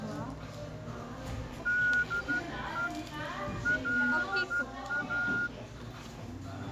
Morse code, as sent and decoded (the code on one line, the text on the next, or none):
-.. . / .-.. .-
DE LA